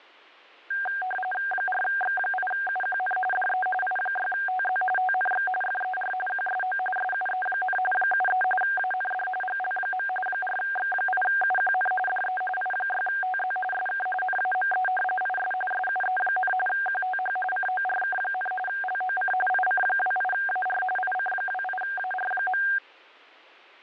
RTTY (45.45 baud, 850 Hz shift), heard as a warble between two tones, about 1170 Hz centre. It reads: 4X8UQN DE I6TZ TNX FER QSO SUE, 73 AND GL. 4X8UQN DE I6TZ SK NAME IS SUE, QTH CORK, LOC IC28AR IC28AR.